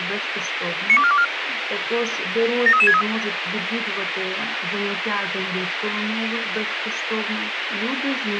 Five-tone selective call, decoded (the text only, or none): 92424 73363